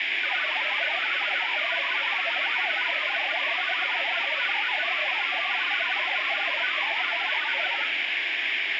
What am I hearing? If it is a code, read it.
Multi-tone FSK (Olivia or MFSK type), about 1000 Hz wide, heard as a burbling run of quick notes, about 62.5 baud, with radio static.